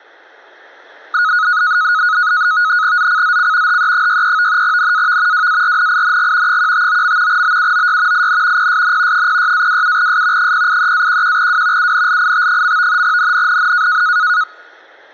NAVTEX (SITOR-B), 100 baud, 170 Hz shift, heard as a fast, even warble, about 1360 Hz centre. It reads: ZCZC HE63 NAV WARNING 159. BUOY IN PSN 06-27S 083-11W UNLIT. NNNN